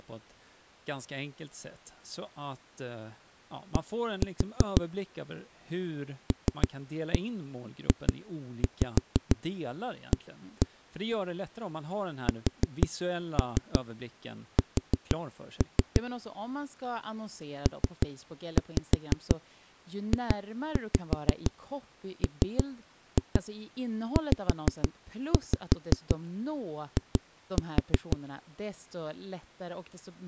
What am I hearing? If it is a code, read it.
Tap code, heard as knocks on a wall, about 6 knocks a second, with speech in Swedish. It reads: D LJA SS PJMZI